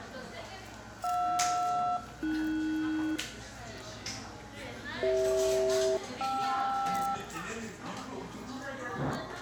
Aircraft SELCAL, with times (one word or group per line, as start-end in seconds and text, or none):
1.0-3.2 JR-AS
5.0-7.2 CH-KR